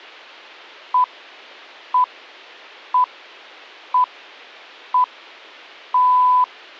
Radio time signal (six pips, as the Greenwich Time Signal), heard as pips.